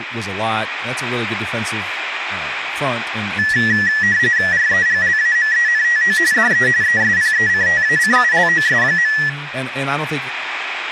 RTTY (45.45 baud, 170 Hz shift), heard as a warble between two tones, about 1800 Hz centre, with radio static and speech in English. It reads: REGLAMENTO DE ESPECTACULOS.